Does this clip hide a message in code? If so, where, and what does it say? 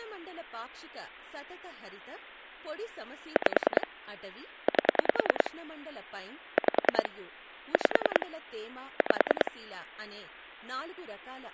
Yes: pulse dialling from 3.4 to 9.5 s, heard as clicks on a phone line, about 10 pulses a second, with speech in Telugu. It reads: 5 8 5 5 5